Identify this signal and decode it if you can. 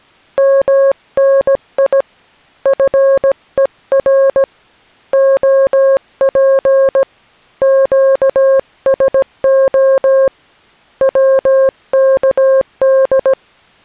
Morse code, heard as a keyed tone, hand-sent with a paddle, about 17 wpm, 540 Hz. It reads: MNI FER OP QSO WKD